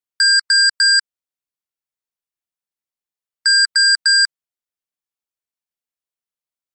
Beep code, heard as beeps from a small speaker, played twice, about 1600 Hz. 3 short. In AMI BIOS tables: failure in the first 64 KB of memory; in Dell tables: chipset error.